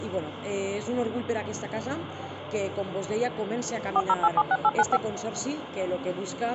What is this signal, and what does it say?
DTMF, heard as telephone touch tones, dialled by machine, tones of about 50 ms. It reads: 40876895